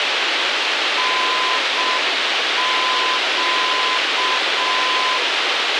Morse code, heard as a keyed tone, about 6 wpm, 1020 Hz, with radio hiss and a squelch burst at the end. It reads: NQ